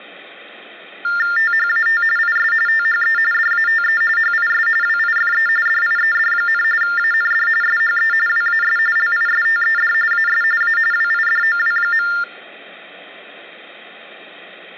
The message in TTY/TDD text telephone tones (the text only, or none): THAT IS THE DATE HIS WIFE DIED, AND SHE WAS LISTED AS A WIDOW.